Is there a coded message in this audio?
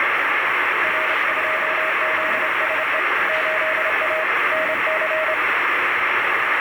Yes: Morse code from 0.8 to 5.4 s, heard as a keyed tone, hand-sent with a straight key, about 28 wpm, 630 Hz, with heavy radio static. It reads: R2ZSE 8A NC